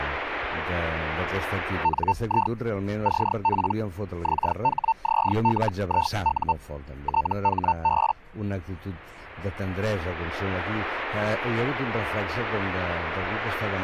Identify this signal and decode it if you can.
Hellschreiber (Feld-Hell, 122.5 baud), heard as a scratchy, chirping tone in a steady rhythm, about 900 Hz. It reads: NI CP XHZLIU THB